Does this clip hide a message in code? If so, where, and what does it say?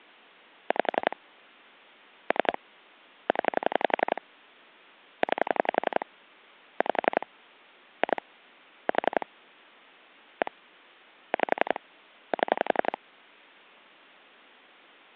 Yes: pulse dialling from 0.7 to 13.0 s, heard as clicks on a phone line, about 11 pulses a second. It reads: 5 3 0 9 5 2 4 1 5 7